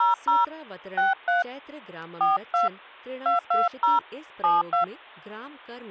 DTMF, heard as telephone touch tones, dialled by hand, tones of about 160 ms, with speech in Hindi. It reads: 00 63 42 220 72